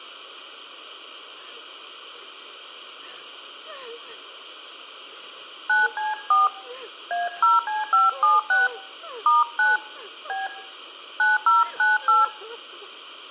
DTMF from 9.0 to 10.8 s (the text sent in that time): *9 B